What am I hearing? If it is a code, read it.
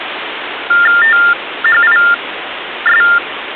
TTY/TDD text telephone tones (45.45 baud Baudot), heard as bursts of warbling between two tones, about 400 Hz shift, 1600 Hz centre, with phone line noise. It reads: THIS